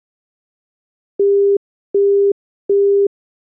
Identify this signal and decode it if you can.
Telephone call progress tone (as in the UK, Australia and similar networks), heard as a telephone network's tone, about 400 Hz, 0.375 s on and 0.375 s off. Busy tone.